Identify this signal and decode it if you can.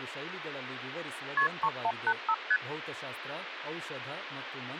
Multi-frequency trunk signalling (R1, as on North American trunks), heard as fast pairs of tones, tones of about 60 ms, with phone line noise and speech in Kannada. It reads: KP 3185 ST